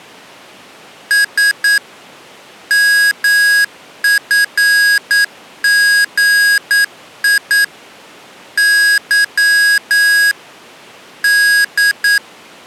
Morse code, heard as electronic beeps, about 9 wpm, 1650 Hz. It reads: S MFGI Y D